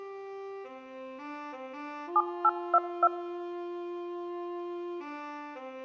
DTMF, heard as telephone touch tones, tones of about 50 ms. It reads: 7822